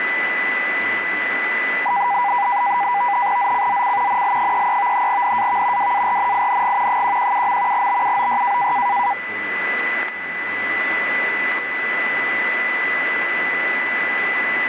NAVTEX (SITOR-B), 100 baud, 170 Hz shift, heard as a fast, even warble, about 890 Hz centre, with radio static, a steady whistle near 2000 Hz and speech in English. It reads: ZCZC NL33 NAV WARNING 117. BUOY